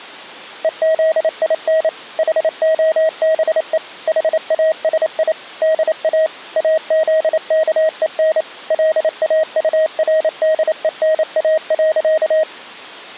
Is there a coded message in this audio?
Yes: Morse code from 0.6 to 12.5 s, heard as a keyed tone, machine-sent, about 28 wpm, 630 Hz. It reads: EZIN HOBE HASI DA AZKEN LAURDENA.